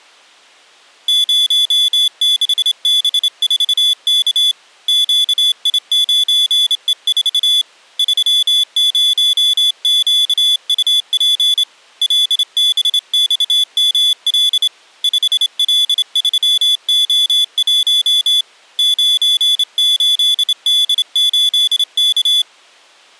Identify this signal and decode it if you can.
Morse code, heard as a high beeper, hand-sent with a straight key, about 27 wpm, 3450 Hz. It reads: 06B4K QI9E4 30QUP LBXML 5L3O1 98D8K